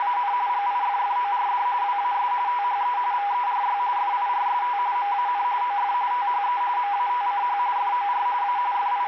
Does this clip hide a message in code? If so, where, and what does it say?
Yes: RTTY (45.45 baud, 170 Hz shift) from 0.0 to 9.1 s, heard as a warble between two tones, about 900 Hz centre, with radio static. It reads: … GIFFORD WAS THE VERY FIRST MAN OF THE MATCH FOR A …